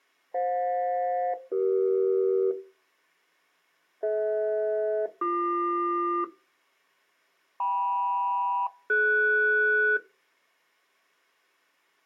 Aircraft SELCAL, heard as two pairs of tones. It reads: FJ-CE DH-BQ KM-DS